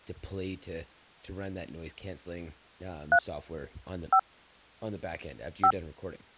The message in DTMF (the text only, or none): 3 5 5